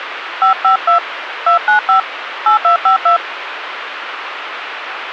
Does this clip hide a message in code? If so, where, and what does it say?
Yes: DTMF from 0.4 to 3.2 s, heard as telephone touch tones, dialled by hand, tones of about 110 ms, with radio hiss. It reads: 552 295 8252